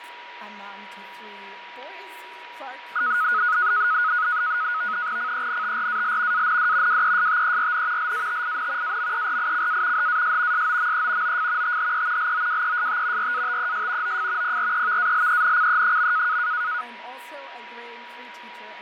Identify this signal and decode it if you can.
NAVTEX (SITOR-B), 100 baud, 170 Hz shift, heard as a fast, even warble, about 1360 Hz centre, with radio static, fading and a steady whistle near 960 Hz. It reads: CENTRAL AND WESTERN LATIN AMERICA HAS SOME OF THE LOWEST RATES OF PREVALENCE.